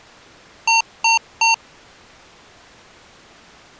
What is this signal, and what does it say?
Beep code, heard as beeps from a small speaker, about 910 Hz. 3 short. In AMI BIOS tables: failure in the first 64 KB of memory; in Dell tables: chipset error.